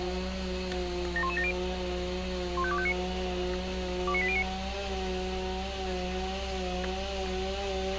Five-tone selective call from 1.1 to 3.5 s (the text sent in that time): 71170 15259